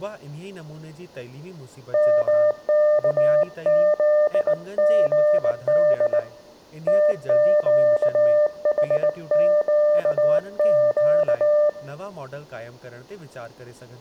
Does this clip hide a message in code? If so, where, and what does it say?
Yes: Morse code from 1.9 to 11.8 s, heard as a keyed tone, hand-sent with a bug key, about 19 wpm, 600 Hz, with room echo and speech in Sindhi. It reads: MKZGD TQHQQ